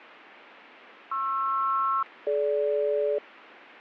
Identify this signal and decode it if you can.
Aircraft SELCAL, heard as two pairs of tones, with radio static. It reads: PR-DG